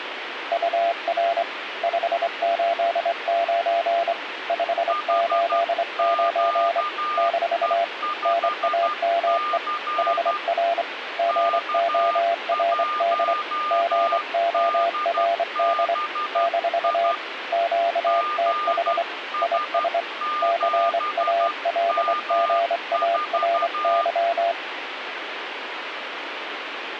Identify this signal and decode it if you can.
Morse code, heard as two keyed tones, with radio static. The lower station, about 25 wpm, 680 Hz: UR 589 589 - NAME HR GORD GORD - QTH IS CALGARY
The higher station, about 12 wpm, 1210 Hz: HQE5C K1DBI GS7M4